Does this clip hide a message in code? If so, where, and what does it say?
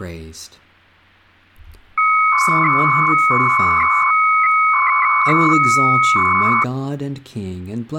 Yes: 300-baud modem data (Bell 103 tones) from 2.0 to 6.6 s, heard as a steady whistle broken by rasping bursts, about 300 baud, 200 Hz shift, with speech in English.